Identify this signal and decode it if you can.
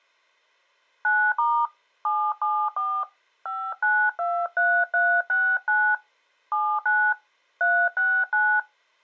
DTMF, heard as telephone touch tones, dialled by hand, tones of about 270 ms. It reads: 9* 774 5923369 79 369